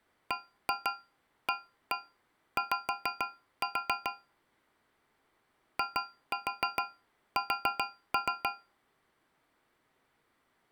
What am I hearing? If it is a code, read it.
Tap code, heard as taps on a metal pipe, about 6 knocks a second. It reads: BAY IS